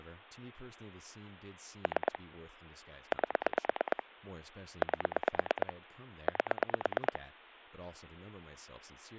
Pulse dialling, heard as clicks on a phone line, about 9 pulses a second, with speech in English. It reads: 3 8 8 8